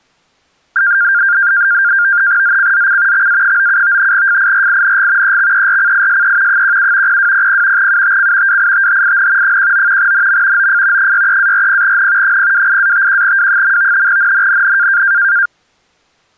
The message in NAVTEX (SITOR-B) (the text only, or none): ZCZC XA97 FIRING EXERCISE 17 0200 UTC WITHIN 19 NM OF 63-40N 028-51W. NNNN